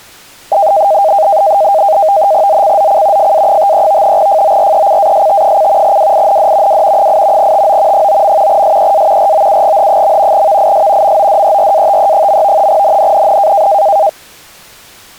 NAVTEX (SITOR-B), 100 baud, 170 Hz shift, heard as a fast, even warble, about 710 Hz centre. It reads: ZCZC FA53 FORECAST: WIND W 8 TO 9. SEA ROUGH. VIS MODERATE. NNNN